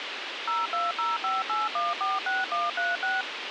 DTMF, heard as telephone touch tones, dialled by machine, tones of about 180 ms, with radio hiss. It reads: 02058146136